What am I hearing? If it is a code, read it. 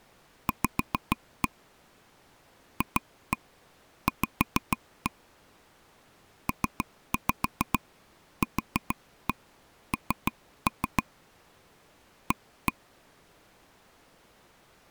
Tap code, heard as taps on a table, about 6 knocks a second. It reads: V FV PQN A